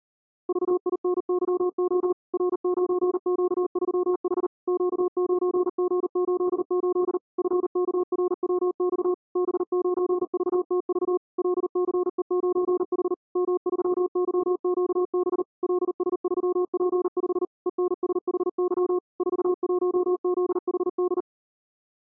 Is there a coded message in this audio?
Yes: Morse code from 0.4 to 21.3 s, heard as a keyed tone, machine-sent, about 39 wpm, 360 Hz. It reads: VINYO R9Q3H Q9G88 FKRWX B9VTV LCE9H M3YQB LS3P5 ENSHY 41ZHD